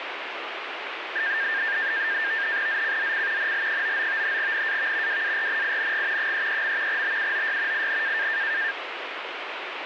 NAVTEX (SITOR-B), 100 baud, 170 Hz shift, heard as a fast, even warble, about 1700 Hz centre, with radio static. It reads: ZCZC NL99 NAV WARNING 33. BUOY IN